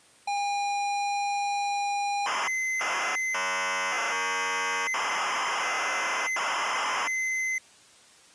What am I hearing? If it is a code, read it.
ZX Spectrum tape loading, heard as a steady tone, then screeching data.